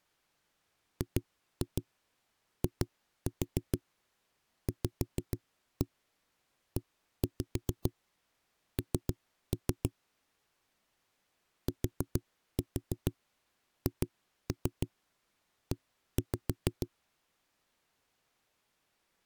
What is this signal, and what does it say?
Tap code, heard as knocks on a wall, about 6 knocks a second. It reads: GIVEN THE